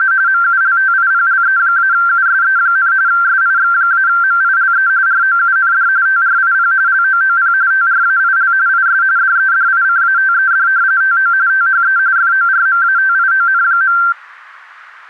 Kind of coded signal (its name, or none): RTTY